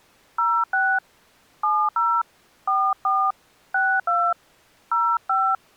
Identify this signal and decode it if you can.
DTMF, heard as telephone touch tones, dialled by hand, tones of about 260 ms. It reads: 06 70 44 62 05